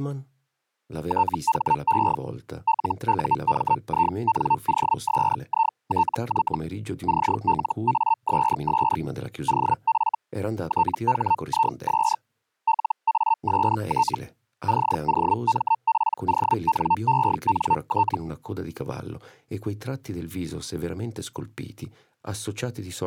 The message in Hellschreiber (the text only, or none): THE LUMINOSITY CLASS OF THIS LAST COMPONENT